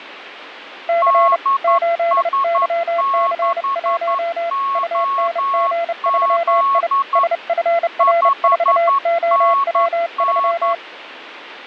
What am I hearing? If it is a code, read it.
Morse code, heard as two keyed tones, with radio static. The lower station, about 30 wpm, 680 Hz: C 8YC1 UNG3I SFR4OW3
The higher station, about 11 wpm, 1100 Hz: DS6OZ 5NN